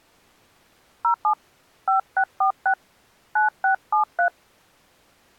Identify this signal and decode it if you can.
DTMF, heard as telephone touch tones, dialled by hand, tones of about 100 ms. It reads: 07 5646 9673